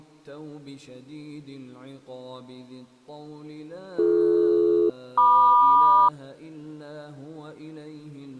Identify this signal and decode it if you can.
Aircraft SELCAL, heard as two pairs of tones. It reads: BD-MQ